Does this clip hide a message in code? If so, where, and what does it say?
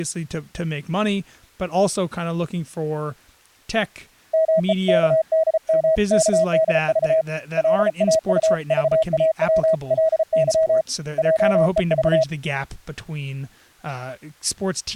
Yes: Morse code (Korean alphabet) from 4.3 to 12.3 s, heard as a keyed tone, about 34 wpm, 640 Hz, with speech in English. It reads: 마음을 괴롭게 할